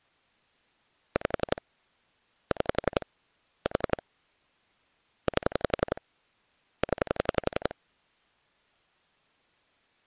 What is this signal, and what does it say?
Pulse dialling, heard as clicks on a phone line, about 11 pulses a second. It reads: 5 6 4 8 0